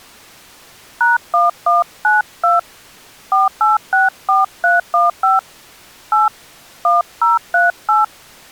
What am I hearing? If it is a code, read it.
DTMF, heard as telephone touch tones, dialled by hand, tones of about 160 ms. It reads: #1192 4864315 8 1038